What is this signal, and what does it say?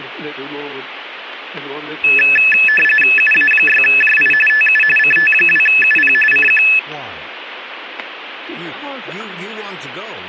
RTTY (45.45 baud, 850 Hz shift), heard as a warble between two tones, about 2150 Hz centre, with radio static and static crashes. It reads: UA6JI TU CT2UP CQ